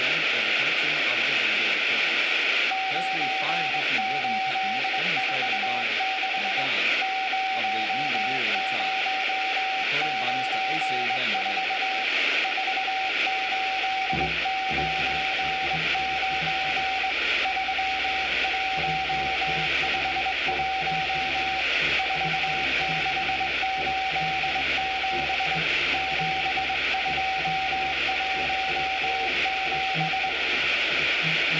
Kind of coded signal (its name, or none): Morse code